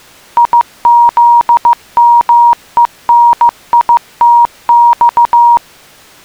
Morse code (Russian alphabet), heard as a keyed tone, machine-sent, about 15 wpm, 950 Hz. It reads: ИЗМЕНИТЬ